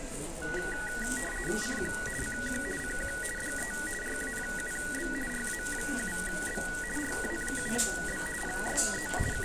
RTTY (50 baud, 450 Hz shift), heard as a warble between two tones, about 1700 Hz centre, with the noise of a crowd indoors. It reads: CQ CQ CQ DE RA7B RA7B RA7B PSE …